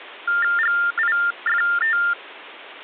TTY/TDD text telephone tones (45.45 baud Baudot), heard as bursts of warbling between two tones, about 400 Hz shift, 1600 Hz centre. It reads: GIFT